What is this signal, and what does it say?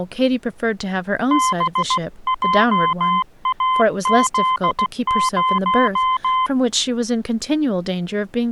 Morse code, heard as a keyed tone, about 16 wpm, 1030 Hz, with speech in English. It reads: BJAZ0